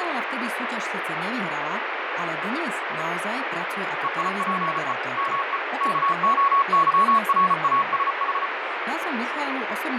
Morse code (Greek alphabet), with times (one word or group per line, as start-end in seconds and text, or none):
4.0-4.9 ΕΙΠΕ
5.2-5.6 ΜΕ
5.8-8.5 ΚΟΥΡΑΣΗ